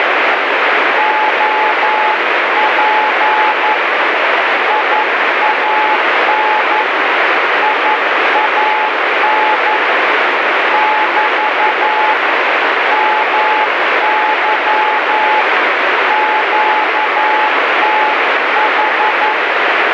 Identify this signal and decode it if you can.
Morse code, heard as a keyed tone, hand-sent with a paddle, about 11 wpm, 860 Hz, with heavy radio static. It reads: OP IAN IAN <BT> MY QTH